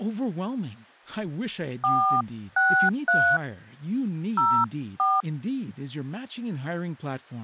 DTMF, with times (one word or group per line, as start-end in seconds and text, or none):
1.8-3.4 463
4.4-5.2 04